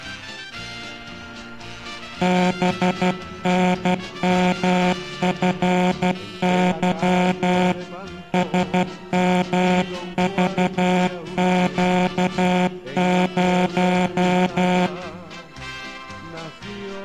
Morse code, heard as a buzzer, hand-sent with a paddle, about 12 wpm. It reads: BNMFY SMVQ0